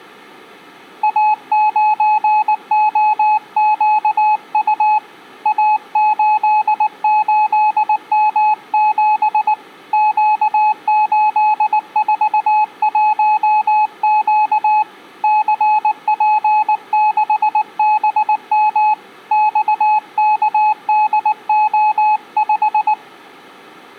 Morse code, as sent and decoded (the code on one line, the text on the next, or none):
.- ----. --- --.- ..- / .- ---.. ---.. -- --... / --.- ---.. ....- .---- --.- / -.-. .--. -.... -... -- / -..- -.- -.. --- .....
A9OQU A88M7 Q841Q CP6BM XKDO5